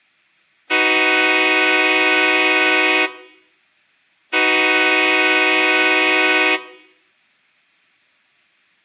Train horn signal, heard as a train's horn, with room echo. 2 long. On North American railways: brakes released, proceed.